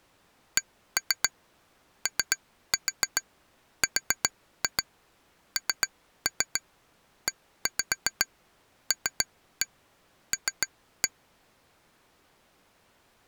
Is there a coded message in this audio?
Yes: tap code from 0.6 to 11.1 s, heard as taps on glass, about 7 knocks a second. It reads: CORNELL